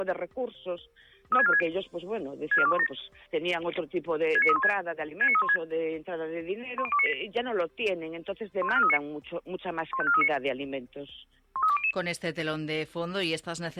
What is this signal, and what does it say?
Five-tone selective call (ZVEI), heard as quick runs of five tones, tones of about 70 ms. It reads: 36460 64217 69316 69316 10298 15439 15439 13200